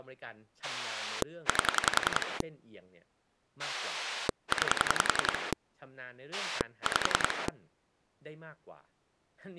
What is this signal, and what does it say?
Pulse dialling, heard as a rotary dial, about 10 pulses a second, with speech in Thai. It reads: 8 9 5